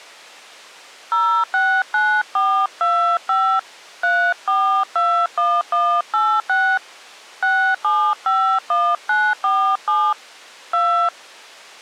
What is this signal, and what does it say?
DTMF, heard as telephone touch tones, dialled by hand, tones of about 300 ms. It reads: 069425 3421186 6751947 2